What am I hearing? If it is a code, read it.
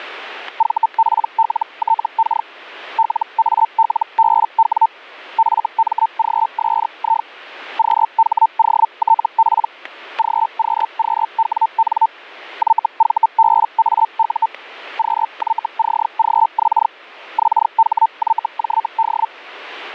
Hellschreiber (Feld-Hell, 122.5 baud), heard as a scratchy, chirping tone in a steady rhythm, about 900 Hz, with static crashes. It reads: VPLTK LALBW FMGSI QHOTP GQQWN YVBAU QYCGX XHYJD